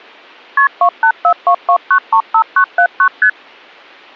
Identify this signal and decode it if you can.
Multi-frequency trunk signalling (R1, as on North American trunks), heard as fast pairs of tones, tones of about 80 ms. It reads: KP 28422935979 ST